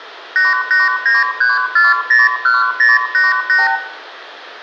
Multi-frequency trunk signalling (R2, with the far end's replies), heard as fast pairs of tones, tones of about 170 ms, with room echo. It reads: 8893401088